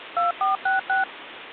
DTMF, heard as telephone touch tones, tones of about 140 ms, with phone line noise. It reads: 2466